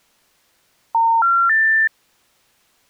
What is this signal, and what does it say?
Telephone call progress tone (North American plan), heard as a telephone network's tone, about 910, 1370, 1800 Hz. Special information tone.